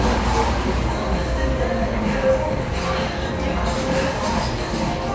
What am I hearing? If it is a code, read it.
The noise of a cafe. There is no code.